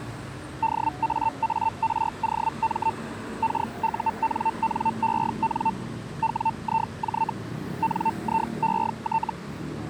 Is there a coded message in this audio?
Yes: Hellschreiber (Feld-Hell, 122.5 baud) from 0.6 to 9.3 s, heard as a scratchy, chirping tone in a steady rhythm, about 900 Hz, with street noise. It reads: DAAROM KUNNEN WIJ NIET